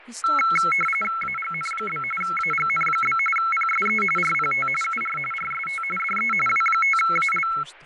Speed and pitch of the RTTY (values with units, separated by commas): 45.45 baud, 850 Hz shift, 1750 Hz centre